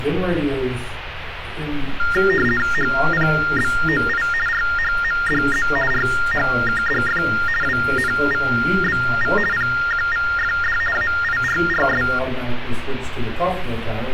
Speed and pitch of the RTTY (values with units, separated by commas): 50 baud, 450 Hz shift, 1600 Hz centre